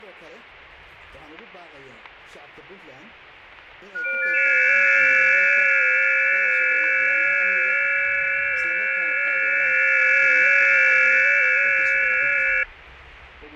FT8 (several signals at once), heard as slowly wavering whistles, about 6.25 baud, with radio static and static crashes.